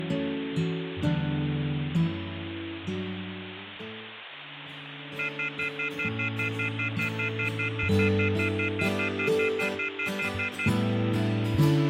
Telephone call progress tone (North American plan), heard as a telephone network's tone, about 1400, 2050, 2450, 2600 Hz, 0.1 s on and 0.1 s off, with phone line noise. Off-hook warning tone.